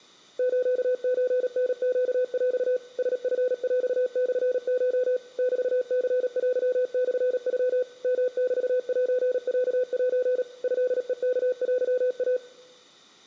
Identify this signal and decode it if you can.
Morse code (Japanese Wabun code), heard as a keyed tone, machine-sent, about 37 wpm, 500 Hz, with room echo. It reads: スソタネヰ ラチヰモコ メニテモノ ヨメセロセ トヘワテイ